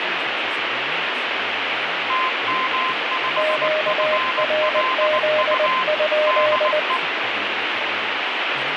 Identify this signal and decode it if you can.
Morse code, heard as two keyed tones, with radio static and speech in English. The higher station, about 19 wpm, 1040 Hz: TM5FLU DE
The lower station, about 20 wpm, 610 Hz: QRZ?